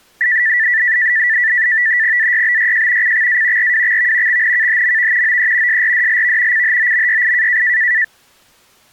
NAVTEX (SITOR-B), 100 baud, 170 Hz shift, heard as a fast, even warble, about 1850 Hz centre. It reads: AYBYJ CXA RWXV XNKHMV OE SRDLV CHOMYI